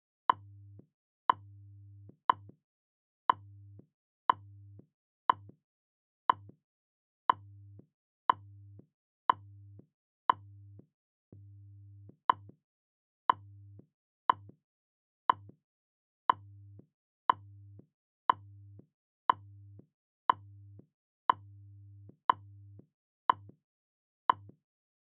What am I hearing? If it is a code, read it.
Radio time signal (WWV, Colorado), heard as ticks, one a second.